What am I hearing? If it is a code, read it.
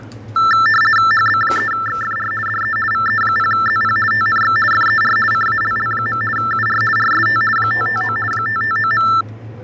RTTY (50 baud, 450 Hz shift), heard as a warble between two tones, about 1550 Hz centre, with fading and the noise of a crowd indoors. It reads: HB3XFR DE VE0ZP TNX FER CALL. UR RST 559 559.